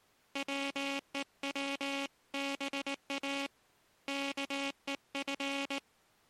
Morse code (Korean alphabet), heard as a buzzer, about 19 wpm. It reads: 밥도 안